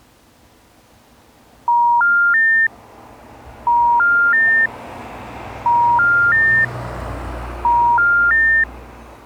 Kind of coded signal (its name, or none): telephone call progress tone